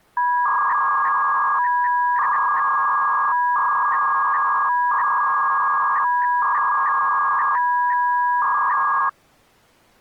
300-baud modem data (V.21 tones), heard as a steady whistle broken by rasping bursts, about 300 baud, 200 Hz shift.